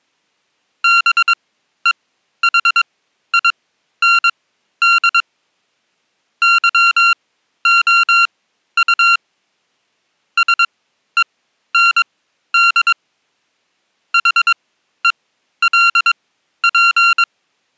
Morse code, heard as electronic beeps, machine-sent, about 22 wpm, spaced as for 12 wpm, 1380 Hz. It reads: BEHIND YOU SEND HELP